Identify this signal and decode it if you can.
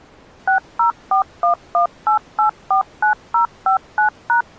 DTMF, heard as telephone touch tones, dialled by machine, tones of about 110 ms. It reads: 604118849059#